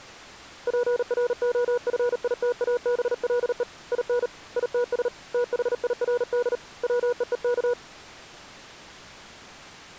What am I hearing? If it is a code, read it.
Morse code, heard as a keyed tone, hand-sent with a paddle, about 38 wpm, 480 Hz. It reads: PROFITABLE IN ITS THIRD WEEK